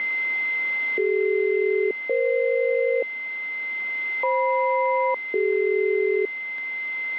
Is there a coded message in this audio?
Yes: aircraft SELCAL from 1.0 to 6.3 s, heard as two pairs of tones, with a steady whistle near 2070 Hz. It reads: CD-EF FM-CD